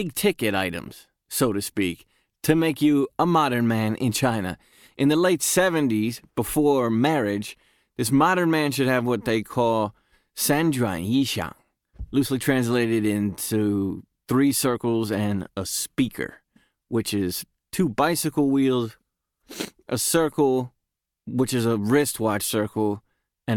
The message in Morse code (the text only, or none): none